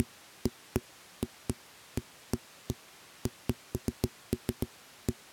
Irregular knocks on a wall. There is no code.